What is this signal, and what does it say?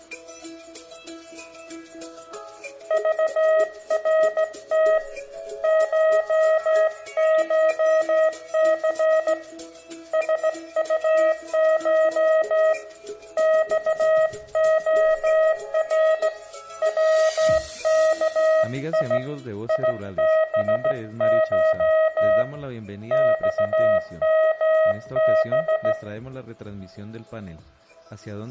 Morse code (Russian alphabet), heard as a keyed tone, hand-sent with a straight key, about 16 wpm, 630 Hz, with room echo. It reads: ЖРТ ШШЦ СУШ ЬОР ВКИ ИБШ ЬМБ